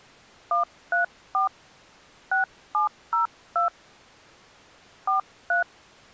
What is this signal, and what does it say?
DTMF, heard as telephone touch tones, dialled by hand, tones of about 130 ms. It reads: 134 6702 43